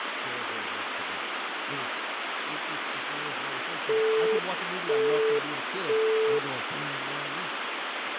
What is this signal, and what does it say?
Telephone call progress tone (single-tone plan, as in Europe, Japan and elsewhere), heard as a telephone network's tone, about 440 Hz, 0.5 s on and 0.5 s off, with phone line noise and speech in English. Busy tone.